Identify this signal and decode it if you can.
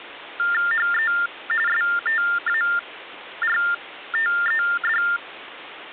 TTY/TDD text telephone tones (45.45 baud Baudot), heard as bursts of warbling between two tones, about 400 Hz shift, 1600 Hz centre, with phone line noise. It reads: HE STARTED